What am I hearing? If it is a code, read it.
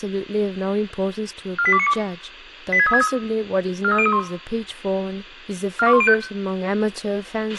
Five-tone selective call (ZVEI), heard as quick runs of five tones, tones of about 70 ms, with a squelch burst at the end, room echo and speech in English. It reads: 48292 86363 43031 42105